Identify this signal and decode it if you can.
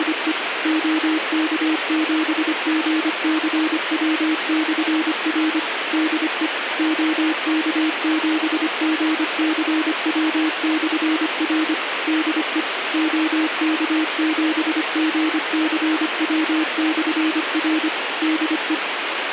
Morse code, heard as a keyed tone, machine-sent, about 25 wpm, 320 Hz, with radio hiss. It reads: … OK7GCW/R DE OK7GCW/R DE OK7GCW/R DE